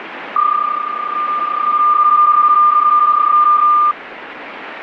PSK31 (31.25 baud), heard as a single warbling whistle, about 1200 Hz, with radio static.